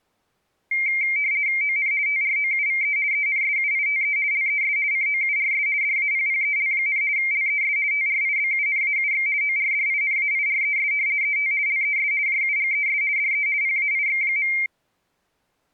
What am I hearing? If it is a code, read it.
RTTY (50 baud, 170 Hz shift), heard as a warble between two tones, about 2200 Hz centre. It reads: ON TROUVE ENSUITE LES COURS DAPPEL, LES TRIBUNAUX ORDINAIRES ET LES JUGES DE PAIX.